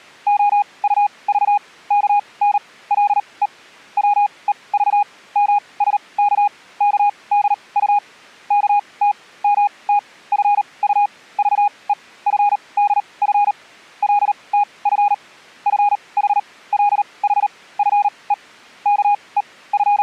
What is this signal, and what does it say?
Morse code (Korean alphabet), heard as a keyed tone, machine-sent, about 38 wpm, spaced as for 25 wpm, 820 Hz. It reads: 필요가 발명의 어머니라는 건 누구나 …